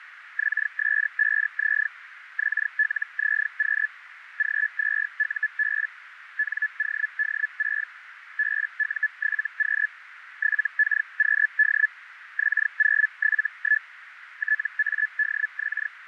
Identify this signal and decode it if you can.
Hellschreiber (Feld-Hell, 122.5 baud), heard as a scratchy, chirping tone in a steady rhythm, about 1700 Hz, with radio static and a narrow filter. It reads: XS5Z XLZQ G2UB NOD6 BU7Q 7KQD X071 TADX